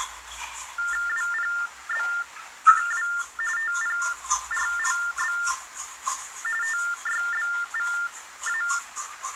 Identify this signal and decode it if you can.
TTY/TDD text telephone tones (45.45 baud Baudot), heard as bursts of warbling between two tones, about 400 Hz shift, 1600 Hz centre, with the noise of a restroom. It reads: WPBQW TPRLB TYBVA